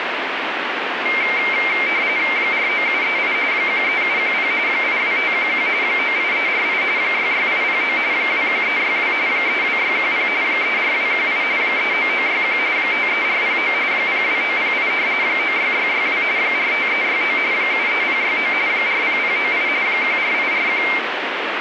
RTTY (45.45 baud, 170 Hz shift), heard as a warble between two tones, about 2200 Hz centre, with radio static. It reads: 49738 13710 82511 98348 66809 21362 32610 34218 39961 53409 02908 96662 45369 73069 40098 14841